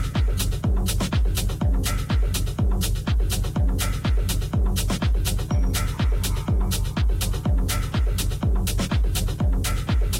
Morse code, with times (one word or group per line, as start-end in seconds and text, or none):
none